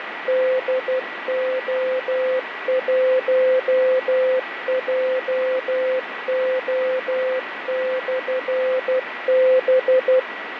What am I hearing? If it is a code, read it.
Morse code, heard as a keyed tone, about 12 wpm, 520 Hz, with radio static, fading and a steady whistle near 1940 Hz. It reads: DO1JO/B